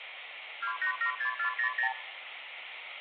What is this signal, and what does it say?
Multi-frequency trunk signalling (R2, with the far end's replies), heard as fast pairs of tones, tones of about 100 ms, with phone line noise. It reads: 2876400